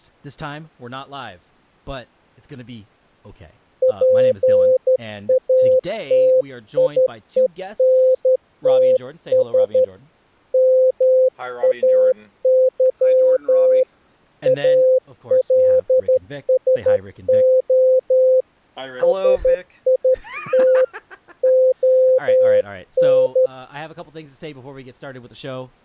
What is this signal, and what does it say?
Morse code, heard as a keyed tone, hand-sent with a straight key, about 12 wpm, 520 Hz, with speech in English. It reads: PATIENTS MAY ALSO SIT ON